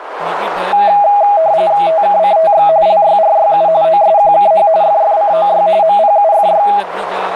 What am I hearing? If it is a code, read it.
RTTY (45.45 baud, 170 Hz shift), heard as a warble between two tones, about 730 Hz centre, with radio static, a narrow filter and speech in Dogri. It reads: TKCTX LYRYU OSQKH FFCOY MPUFY